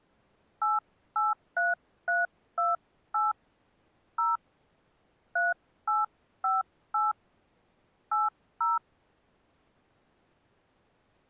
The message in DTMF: 883328 0 3858 80

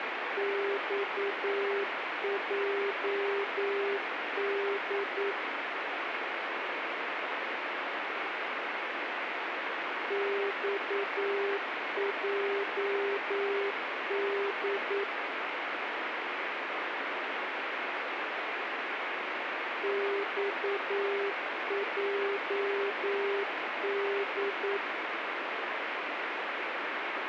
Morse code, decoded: XJD XJD XJD

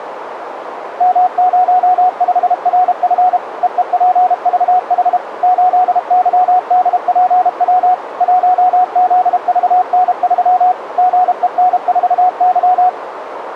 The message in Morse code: M05RF EEPVH 8YDPW 1ZVN3 GEN4Y

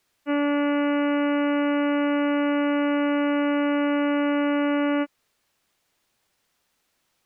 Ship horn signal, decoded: 1 long

